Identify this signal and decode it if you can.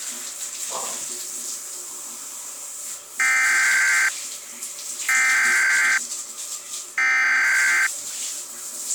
Emergency Alert System (SAME) tones (header bursts), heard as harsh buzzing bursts, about 520.83 baud, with the noise of a restroom.